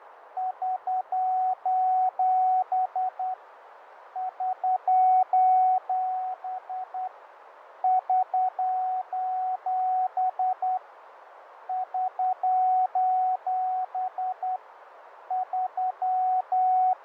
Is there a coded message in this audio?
Yes: Morse code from 0.3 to 17.0 s, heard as a keyed tone, hand-sent with a straight key, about 10 wpm, 740 Hz, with radio static, fading and a narrow filter. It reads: <SOS> <SOS> <SOS> <SOS> …